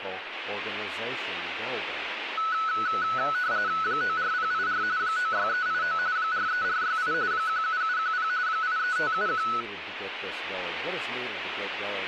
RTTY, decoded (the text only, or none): 94084 96389 43468 17710 83571